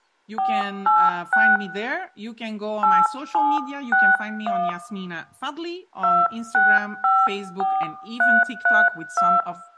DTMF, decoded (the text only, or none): 486 8761 2654332